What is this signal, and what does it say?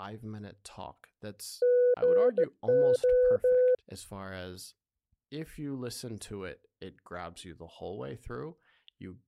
Morse code, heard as a keyed tone, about 17 wpm, 500 Hz, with speech in English. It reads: GO